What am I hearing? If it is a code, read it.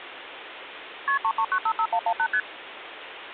Multi-frequency trunk signalling (R1, as on North American trunks), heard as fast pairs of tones, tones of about 70 ms, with phone line noise. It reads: KP 33955118 ST